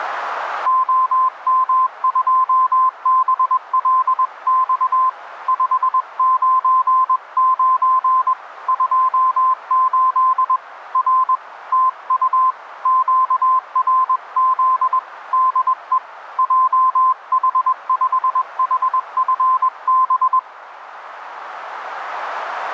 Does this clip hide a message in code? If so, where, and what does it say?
Yes: Morse code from 0.6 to 20.5 s, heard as a keyed tone, hand-sent with a paddle, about 21 wpm, 1040 Hz, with radio static. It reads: OM2BLX 599 28 R TU QRZ DE JH5HFB